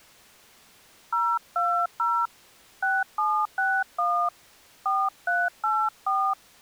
DTMF, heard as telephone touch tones, dialled by hand, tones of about 260 ms. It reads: 020 6761 4384